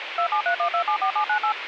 DTMF, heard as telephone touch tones, dialled by machine, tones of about 90 ms, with phone line noise. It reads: 2731274798